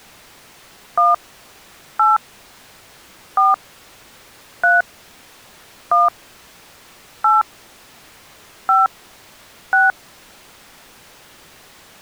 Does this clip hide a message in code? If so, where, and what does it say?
Yes: DTMF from 1.0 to 9.9 s, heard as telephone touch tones, dialled by hand, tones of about 170 ms. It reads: 1 8 4 3 1 8 5 6